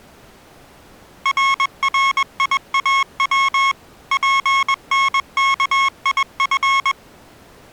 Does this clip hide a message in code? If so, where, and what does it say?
Yes: Morse code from 1.2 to 7.0 s, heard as electronic beeps, machine-sent, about 21 wpm, 1090 Hz. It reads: RRIAW PNKIF